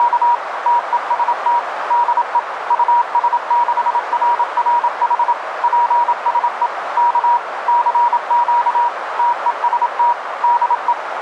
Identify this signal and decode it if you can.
Morse code, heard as a keyed tone, machine-sent, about 27 wpm, 960 Hz, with radio static and a narrow filter. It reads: … TEST DE US6RRH PSE K CQ TEST DE